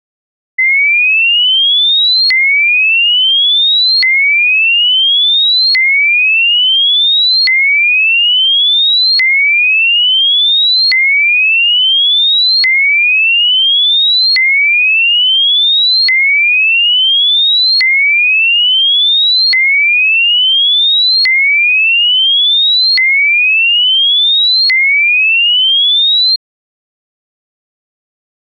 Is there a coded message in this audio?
No, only a tone that sweeps in pitch again and again.